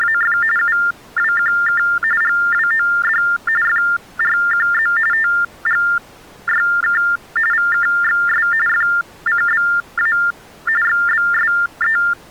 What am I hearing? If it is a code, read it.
TTY/TDD text telephone tones (45.45 baud Baudot), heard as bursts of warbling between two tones, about 400 Hz shift, 1600 Hz centre. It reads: … UWQK GWOD FRQZ TGYK VKXS FCBA XBSE